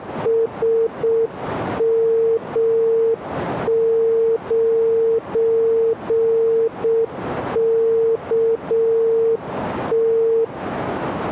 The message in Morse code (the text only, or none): SM9KT